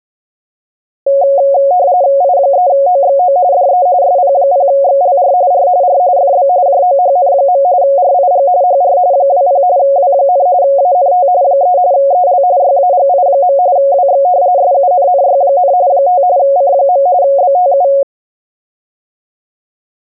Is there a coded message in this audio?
Yes: RTTY (45.45 baud, 170 Hz shift) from 1.1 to 18.0 s, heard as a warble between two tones, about 640 Hz centre. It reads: I3OXO DE SP0XLR R R FB JOHN. RIG HR 20 W, ANT 3 EL YAGI. WX SUNNY, 5 C. BTU